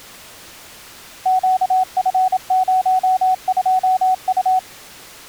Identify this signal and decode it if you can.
Morse code, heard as a keyed tone, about 27 wpm, 750 Hz. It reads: QF02U